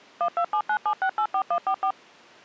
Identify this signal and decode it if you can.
DTMF, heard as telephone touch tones, dialled by machine, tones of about 80 ms. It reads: 12797684144